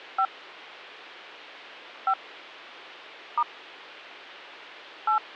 DTMF, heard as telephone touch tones, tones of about 80 ms, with hum. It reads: 5 5 * 8